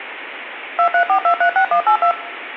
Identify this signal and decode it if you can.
DTMF, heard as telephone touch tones, dialled by machine, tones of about 90 ms, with phone line noise. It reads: 234236182